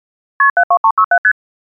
Multi-frequency trunk signalling (R1, as on North American trunks), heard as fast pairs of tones, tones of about 70 ms. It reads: KP 72367 ST